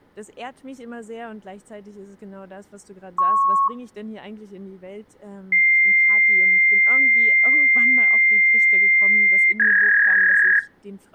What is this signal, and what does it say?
Fax machine handshake, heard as a beep, a long tone and a warble.